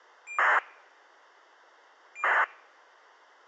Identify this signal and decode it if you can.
ACARS aircraft data, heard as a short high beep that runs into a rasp, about 2400 baud, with a squelch burst at the end.